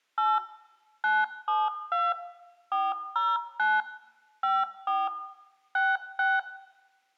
DTMF, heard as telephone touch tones, dialled by machine, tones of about 210 ms, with room echo. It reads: 8 972 409 54 66